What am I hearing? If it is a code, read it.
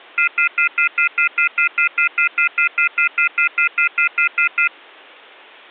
Telephone call progress tone (North American plan), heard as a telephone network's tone, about 1400, 2050, 2450, 2600 Hz, 0.1 s on and 0.1 s off. Off-hook warning tone.